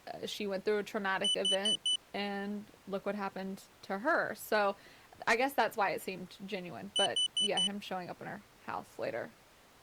Alarm pattern, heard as an alarm's beeps, played twice, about 3000 Hz, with speech in English. Temporal four. Carbon monoxide.